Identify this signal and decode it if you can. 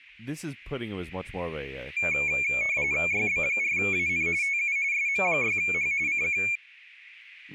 RTTY (45.45 baud, 170 Hz shift), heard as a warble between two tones, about 2300 Hz centre, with static crashes and speech in English. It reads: YB4AN TU SM6H CQ